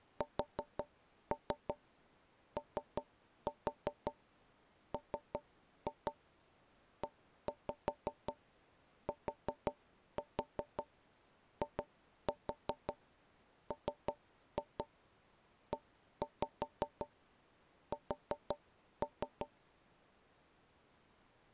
Tap code, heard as knocks on wood, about 5 knocks a second. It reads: SOMETIMES